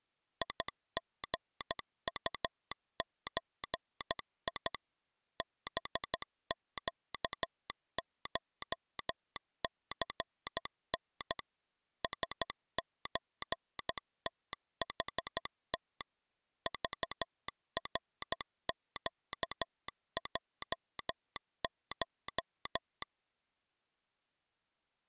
Morse code (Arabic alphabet), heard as a telegraph sounder, machine-sent, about 13 wpm. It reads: يغطزي بقشثن سزتحت ضرقجش